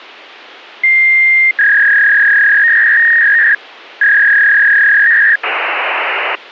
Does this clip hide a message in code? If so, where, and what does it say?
Yes: fax machine handshake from 0.8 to 6.4 s, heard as a long tone, a warble and hiss.